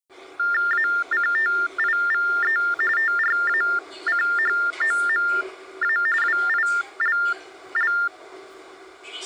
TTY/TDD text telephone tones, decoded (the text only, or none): ACTIVE TRACHOMA WILL